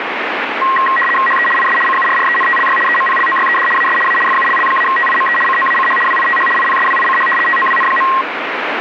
RTTY (75 baud, 850 Hz shift), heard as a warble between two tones, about 1490 Hz centre, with radio static. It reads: HE IS CURRENTLY EMPLOYED AS A FULL-TIME COACH WITH IPSWICH TOWN.